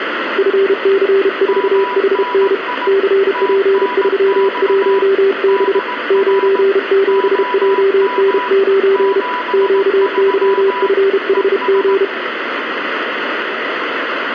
Morse code, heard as two keyed tones, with radio static and room echo. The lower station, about 32 wpm, 390 Hz: FC4HN CP31B 97JN9 QYFHG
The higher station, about 18 wpm, 990 Hz: MNI TNX DR OM 73 ES